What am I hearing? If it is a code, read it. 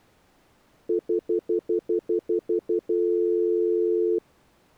Telephone call progress tone (North American plan), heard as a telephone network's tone, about 350, 440 Hz, 0.1 s on and 0.1 s off. Stutter dial tone.